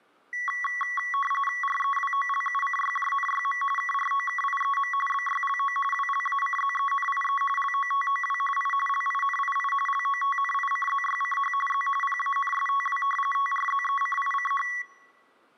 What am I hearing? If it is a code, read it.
RTTY (45.45 baud, 850 Hz shift), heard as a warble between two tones, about 1550 Hz centre. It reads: REWOLUCYJNYM KROKIEM BYLO WLACZENIE LOTOW I LINII LOTNICZYCH Z PANSTW TRZECICH